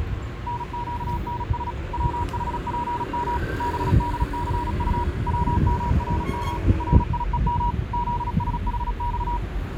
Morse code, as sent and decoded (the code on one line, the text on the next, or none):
-. --.- -. ... / .-- .... .--. -- / -... -.. -.-. ..- / .-- -- .-. -- / .-. .. . -- / --.. ... .... -..-
NQNS WHPM BDCU WMRM RIEM ZSHX